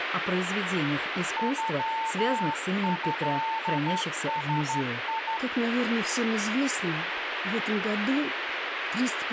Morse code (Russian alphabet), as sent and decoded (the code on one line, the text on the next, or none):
..-- ..-.. ... ..
ЮЭСИ